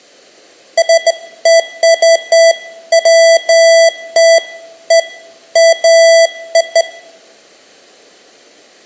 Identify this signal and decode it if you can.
Beeps of irregular length, with room echo. There is no code.